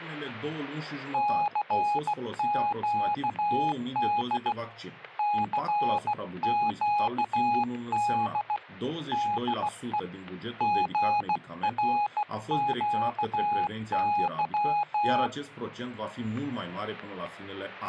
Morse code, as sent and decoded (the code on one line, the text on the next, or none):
-.-. --.- -.. / -.-. --.- -.. / -.. . / --. .-. --.- -.--
CQD CQD DE GRQY